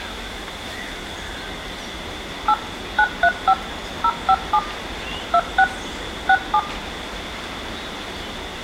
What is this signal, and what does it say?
DTMF, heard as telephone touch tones, dialled by machine, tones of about 60 ms, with room echo. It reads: 8 935 057 26 67